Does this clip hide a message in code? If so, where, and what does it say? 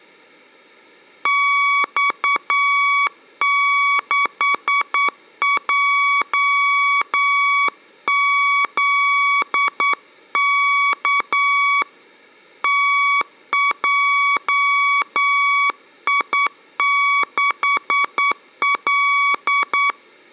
Yes: Morse code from 1.2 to 20.0 s, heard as a keyed tone, hand-sent with a straight key, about 9 wpm, 1130 Hz, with room echo. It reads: X6JZK TJI6L